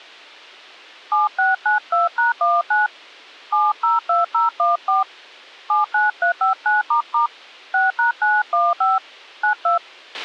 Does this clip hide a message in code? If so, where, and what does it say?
Yes: DTMF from 1.1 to 9.8 s, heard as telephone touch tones, dialled by hand, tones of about 150 ms, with a squelch burst at the end. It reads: 7692#19 702014 79359** 6#915 92